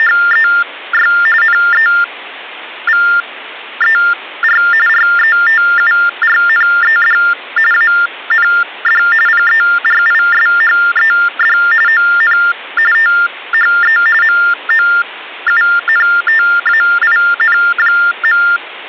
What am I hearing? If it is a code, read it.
TTY/TDD text telephone tones (45.45 baud Baudot), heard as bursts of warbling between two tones, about 400 Hz shift, 1600 Hz centre. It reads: … NEVER RETURNED AND PERISHED ON THE MOUNTAIN.